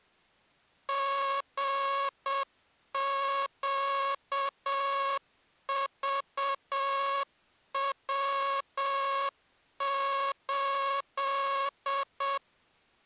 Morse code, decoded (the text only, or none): GQVW8